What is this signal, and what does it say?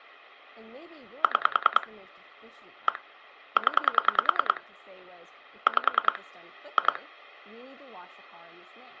Pulse dialling, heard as clicks on a phone line, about 10 pulses a second, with speech in English. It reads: 6 1 0 5 2